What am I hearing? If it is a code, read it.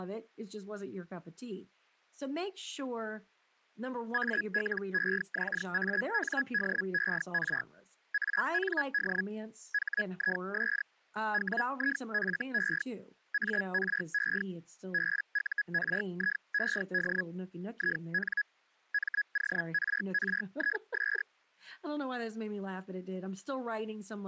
Hellschreiber (Feld-Hell, 122.5 baud), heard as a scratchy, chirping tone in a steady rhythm, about 1650 Hz, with speech in English. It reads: ALEXANDER AND HIS WIFE ARE BURIED IN MORRIS